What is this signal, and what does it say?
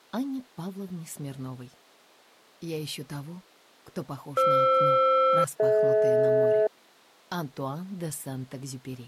Aircraft SELCAL, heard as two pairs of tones. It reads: FR-DH